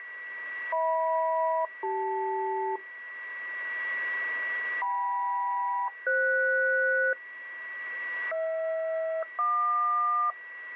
Aircraft SELCAL, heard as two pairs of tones, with a steady whistle near 1940 Hz. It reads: HM-CL KM-FS HR-JQ